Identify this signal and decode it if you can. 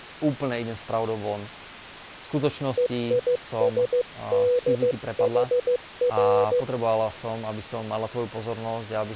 Morse code, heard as a keyed tone, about 15 wpm, 490 Hz, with speech in Slovak. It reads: EISDHR